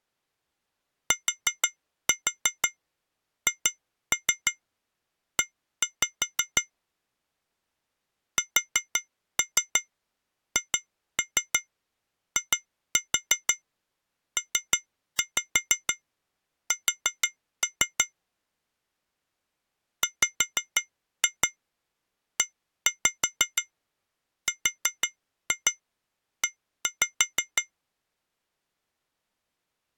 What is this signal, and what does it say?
Tap code, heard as taps on glass, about 6 knocks a second. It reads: THE SHIPS WERE